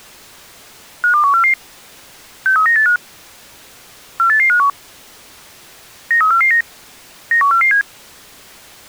Five-tone selective call (CCIR), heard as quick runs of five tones, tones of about 100 ms. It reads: 52144 63985 48851 93449 91447